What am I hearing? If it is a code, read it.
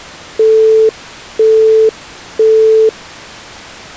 Telephone call progress tone (single-tone plan, as in Europe, Japan and elsewhere), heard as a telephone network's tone, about 440 Hz, 0.5 s on and 0.5 s off. Busy tone.